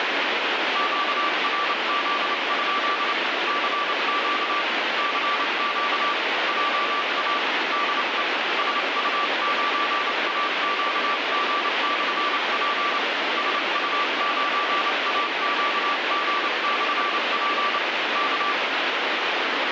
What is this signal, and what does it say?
Morse code, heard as a keyed tone, hand-sent with a paddle, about 28 wpm, 1160 Hz, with heavy radio static. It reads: QRZ? CQ CQ JA DE SU9AQG/P SU9AQG/P K